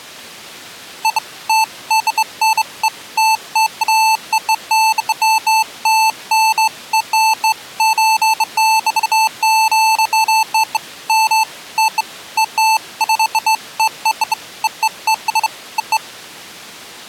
Beeps of irregular length. There is no code.